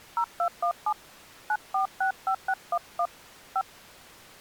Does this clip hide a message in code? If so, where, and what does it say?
Yes: DTMF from 0.2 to 3.6 s, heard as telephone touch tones, dialled by hand, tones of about 80 ms. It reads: 0217 9465611 5